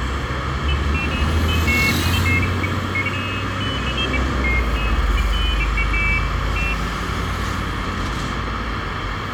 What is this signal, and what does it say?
Pairs of high tones at irregular times, with radio hiss, a squelch burst at the end, room echo and street noise. There is no code.